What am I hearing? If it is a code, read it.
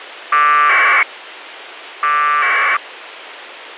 Packet radio (AX.25, as in APRS), 1200 baud, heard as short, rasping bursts, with radio hiss.